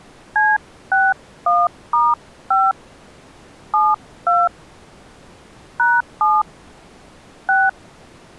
DTMF, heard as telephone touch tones, dialled by hand, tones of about 210 ms. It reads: C61*5 72 #7 6